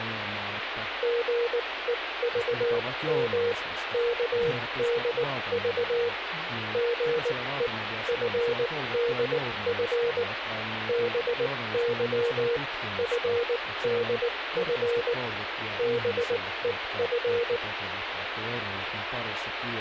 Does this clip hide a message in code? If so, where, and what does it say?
Yes: Morse code (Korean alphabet) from 1.0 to 17.6 s, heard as a keyed tone, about 19 wpm, spaced as for 16 wpm, 470 Hz, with radio static and speech in Finnish. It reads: 삶을 사는 데는 단